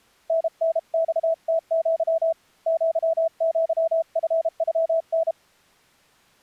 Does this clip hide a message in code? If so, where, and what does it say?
Yes: Morse code (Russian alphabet) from 0.2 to 5.4 s, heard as a keyed tone, hand-sent with a paddle, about 32 wpm, 650 Hz. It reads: ННЬТЪ ЪЪФЮН